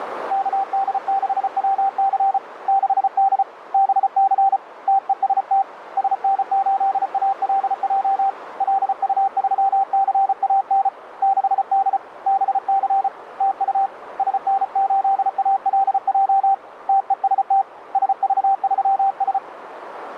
Morse code, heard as a keyed tone, hand-sent with a paddle, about 34 wpm, 780 Hz, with radio static and a narrow filter. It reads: KD6WC 6D BC TEST SN8ALJ LU3CAN 6D BC TU SN8ALJ TEST SV3S